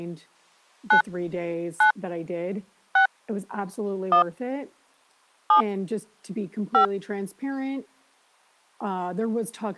DTMF, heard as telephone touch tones, dialled by hand, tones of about 100 ms, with speech in English. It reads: 9 9 6 1 7 5